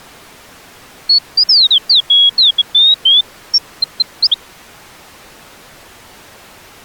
Bird-like chirps. There is no code.